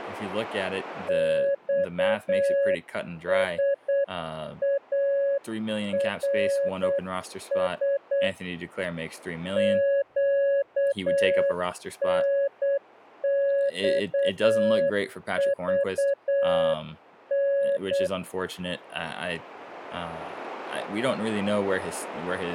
Morse code, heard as a keyed tone, hand-sent with a paddle, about 8 wpm, 560 Hz, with speech in English. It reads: XSARS QNXVN